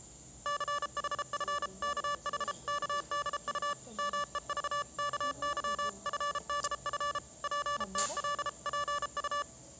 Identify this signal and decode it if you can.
Morse code (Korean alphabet), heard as electronic beeps, machine-sent, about 33 wpm, 580 Hz, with the noise of a cafe. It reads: 춘우의 말에는 적지